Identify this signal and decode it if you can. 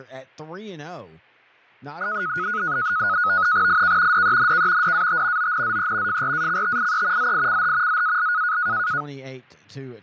NAVTEX (SITOR-B), 100 baud, 170 Hz shift, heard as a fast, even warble, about 1360 Hz centre, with fading, static crashes and speech in English. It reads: IK DENK DAT ONZE FRACTIE ZICH ZAL